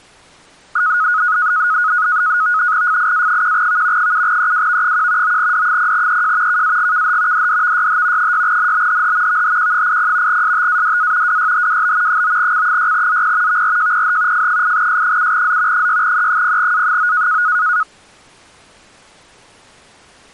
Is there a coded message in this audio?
Yes: NAVTEX (SITOR-B), 100 baud, 170 Hz shift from 0.8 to 17.8 s, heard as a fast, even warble, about 1360 Hz centre. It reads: FIA1V 7EWV1 9D0EJ KAGKH DDVYH 6NBHH VHQ80 STADA WYHWB 9C6ZP VRJPH F8S7Z 6E0A9